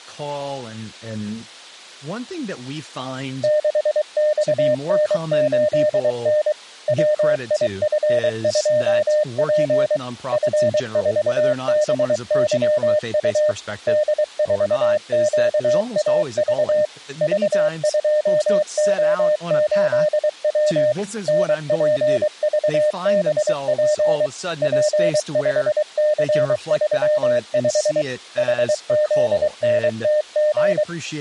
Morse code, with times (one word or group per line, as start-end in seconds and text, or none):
3.4-6.5 6XN8N
6.9-10.0 WIF2P
10.3-13.5 F4BYU
13.9-16.9 D4QAV
17.2-20.9 V2O8W
21.3-24.3 NPVBP
24.6-28.0 P5C35
28.4-30.8 HZNTG